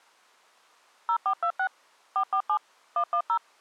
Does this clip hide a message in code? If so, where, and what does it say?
Yes: DTMF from 1.1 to 3.4 s, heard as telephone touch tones, dialled by machine, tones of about 80 ms. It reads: 0426 447 110